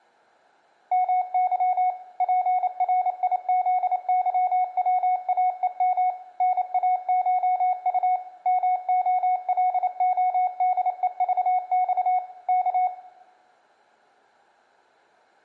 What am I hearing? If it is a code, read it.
Morse code (Russian alphabet), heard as a keyed tone, machine-sent, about 28 wpm, 740 Hz, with room echo. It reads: МЫ ПРИЗЫВАЕМ НАШУ МОЛОДЕЖЬ К